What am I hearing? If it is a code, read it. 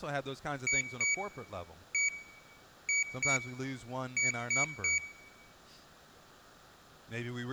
Beep code, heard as a piezo beeper, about 2250 Hz, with room echo and speech in English. 2-1-2-3. In Phoenix BIOS tables: ROM copyright notice check failure.